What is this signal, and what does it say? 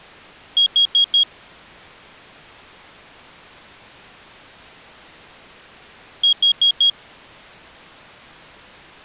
Alarm pattern, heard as an alarm's beeps, played twice, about 3300 Hz. Temporal four. Carbon monoxide.